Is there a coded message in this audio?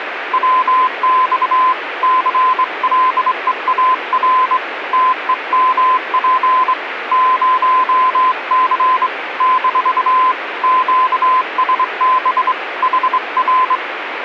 Yes: Morse code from 0.3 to 13.8 s, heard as a keyed tone, hand-sent with a straight key, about 24 wpm, 1020 Hz, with radio static. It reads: WX CLEAR TEMP 0C - QSB HR